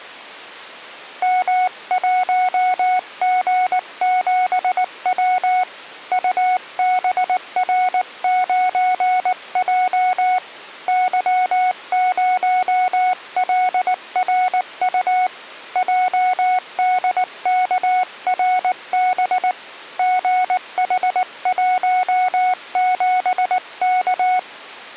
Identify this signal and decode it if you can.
Morse code, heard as a keyed tone, hand-sent with a paddle, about 19 wpm, 740 Hz. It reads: M1G7W UBR9J Y0LRU JDKRB GH17K